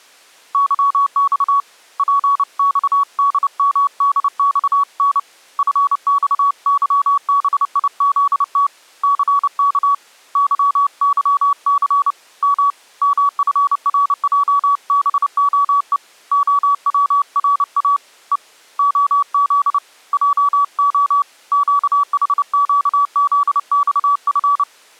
Morse code, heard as a keyed tone, hand-sent with a paddle, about 29 wpm, 1130 Hz. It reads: YX PXDMDXN FXYBIZT CK YYC M MFRJBOE OWRA E OZ JO QHQZXF